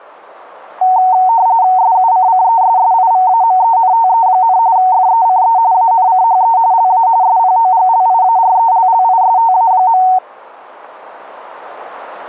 RTTY (45.45 baud, 170 Hz shift), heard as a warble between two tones, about 830 Hz centre. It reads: SUCCESSIVAMENTE, FECE ANCHE LA SPOGLIARELLISTA.